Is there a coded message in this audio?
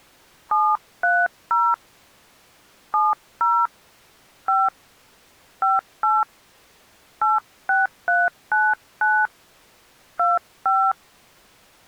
Yes: DTMF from 0.5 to 10.9 s, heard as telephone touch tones, dialled by hand, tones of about 220 ms. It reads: 730 70 5 58 86399 25